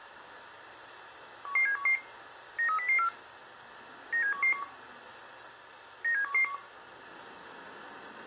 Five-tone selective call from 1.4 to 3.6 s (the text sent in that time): 11711 93004